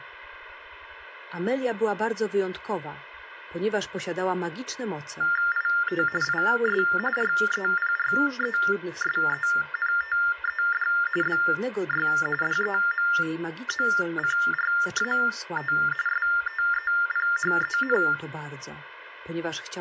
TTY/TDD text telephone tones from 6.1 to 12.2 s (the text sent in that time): IS REPRESENTED BY